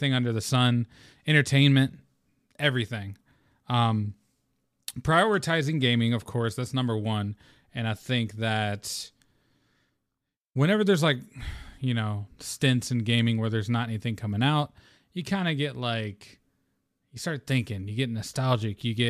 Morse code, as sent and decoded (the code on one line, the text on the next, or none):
none